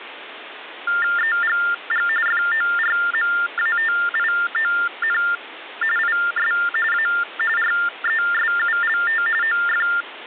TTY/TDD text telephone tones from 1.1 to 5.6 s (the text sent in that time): EGG FORMATION